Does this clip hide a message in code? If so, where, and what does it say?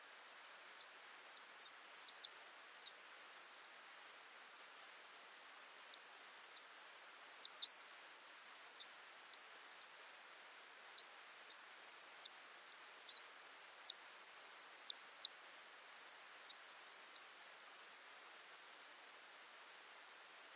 No, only bird-like chirps.